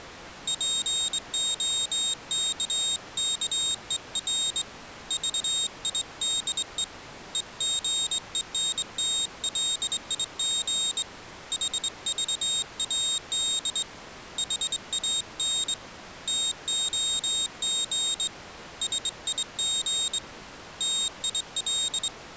Morse code, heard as a high beeper, hand-sent with a straight key, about 22 wpm, 3700 Hz. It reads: POKKER VIDE EGENTLIG HVAD HAN TOG SIG TIL